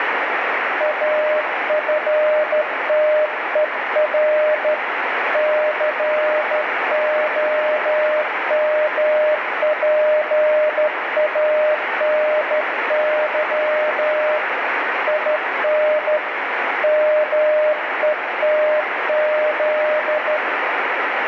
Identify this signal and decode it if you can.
Morse code, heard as a keyed tone, hand-sent with a straight key, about 13 wpm, 610 Hz, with heavy radio static. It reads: AFTER COMPANY IN METZ